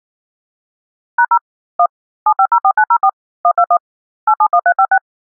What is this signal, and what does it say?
DTMF, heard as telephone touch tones, dialled by machine, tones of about 70 ms. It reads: #0 1 7504904 121 871356